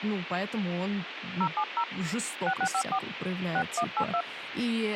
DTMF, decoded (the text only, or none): 070 6654 6182